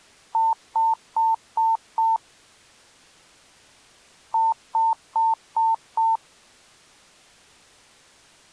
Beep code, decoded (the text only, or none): 5 short